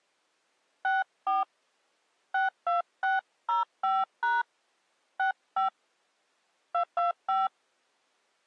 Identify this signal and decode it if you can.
DTMF, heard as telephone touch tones, dialled by hand, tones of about 150 ms. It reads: 64 62605# 65 225